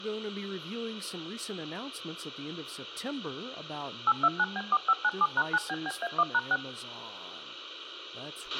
DTMF, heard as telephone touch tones, dialled by machine, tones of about 50 ms, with a squelch burst at the end and speech in English. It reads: 829B4597#9BBA1#6